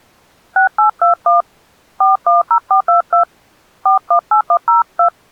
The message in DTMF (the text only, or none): 6821 410422 418102